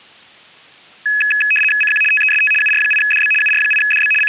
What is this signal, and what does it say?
RTTY (75 baud, 850 Hz shift), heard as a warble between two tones, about 2100 Hz centre. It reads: CQ TEST UR8DB UR8DB …